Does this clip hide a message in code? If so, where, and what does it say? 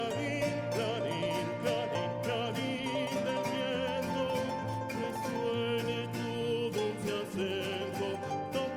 No.